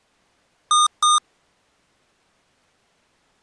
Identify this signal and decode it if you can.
Beep code, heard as beeps from a small speaker, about 1220 Hz. 2 short. In AMI BIOS tables: memory parity error; in IBM BIOS tables: self-test error shown on screen; in Dell tables: no memory detected.